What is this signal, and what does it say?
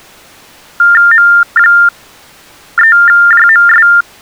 TTY/TDD text telephone tones (45.45 baud Baudot), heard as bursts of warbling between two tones, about 400 Hz shift, 1600 Hz centre. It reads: M3JMS